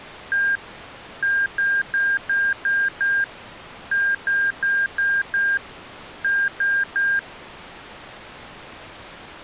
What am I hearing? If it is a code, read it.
Beep code, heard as beeps from a small speaker, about 1600 Hz. 1-6-5-3.